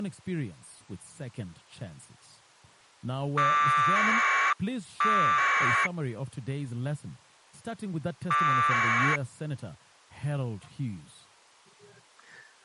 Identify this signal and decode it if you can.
Packet radio (AX.25, as in APRS), 1200 baud, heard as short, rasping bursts.